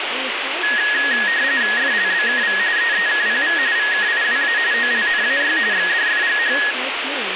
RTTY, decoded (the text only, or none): FLBKV EEKPV VKIWA OLNAY XDFGH